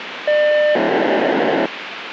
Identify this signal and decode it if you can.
POCSAG pager data (1200 baud), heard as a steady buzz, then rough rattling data, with radio hiss.